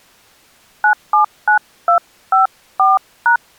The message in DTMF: 979254#

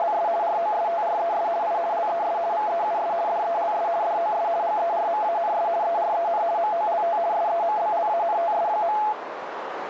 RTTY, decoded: … ROSTRES I LES VEUS DELS DOS GERMANS EREN MOLT SEMBLANTS.

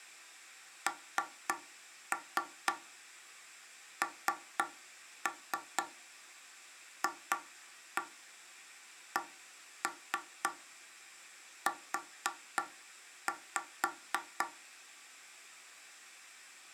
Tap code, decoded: NNFCU

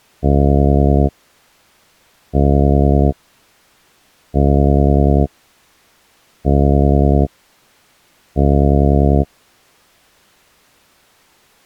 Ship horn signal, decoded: 5 short

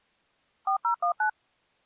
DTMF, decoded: 4019

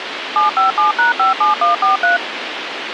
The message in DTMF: 757#57143

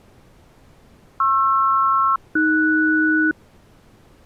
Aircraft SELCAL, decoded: PR-AS

